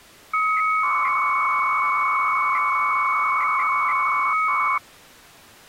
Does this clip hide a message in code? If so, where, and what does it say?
Yes: 300-baud modem data (Bell 103 tones) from 0.3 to 4.8 s, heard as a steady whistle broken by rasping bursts, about 300 baud, 200 Hz shift.